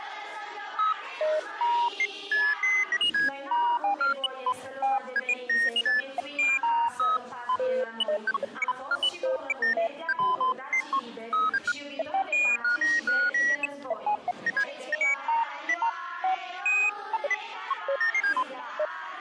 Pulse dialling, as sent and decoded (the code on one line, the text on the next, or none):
none